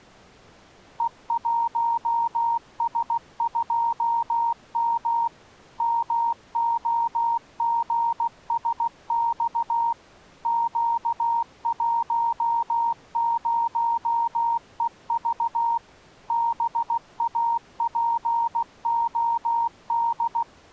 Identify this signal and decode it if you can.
Morse code, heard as a keyed tone, machine-sent, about 16 wpm, 930 Hz. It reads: E1S2M MOGSX Q10EV BAPOD